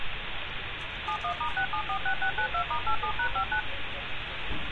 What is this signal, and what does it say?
DTMF, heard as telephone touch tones, dialled by machine, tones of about 90 ms, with phone line noise and street noise. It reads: 71*6746692*87#59